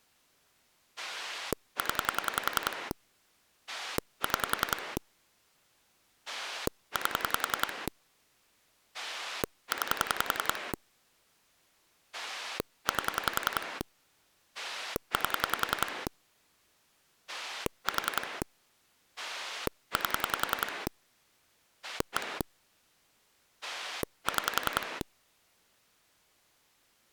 Pulse dialling, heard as a rotary dial, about 10 pulses a second. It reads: 0 6 8 9 8 8 4 8 1 6